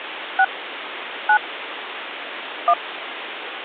DTMF, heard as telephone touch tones, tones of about 80 ms, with phone line noise. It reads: 6 9 1